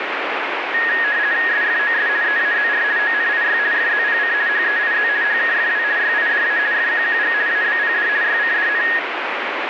RTTY (50 baud, 170 Hz shift), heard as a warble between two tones, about 1750 Hz centre, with radio static. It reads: SFOS EAZR ONIY FZPC HEIZ HKFW YIDA FQQG ABPD YCDN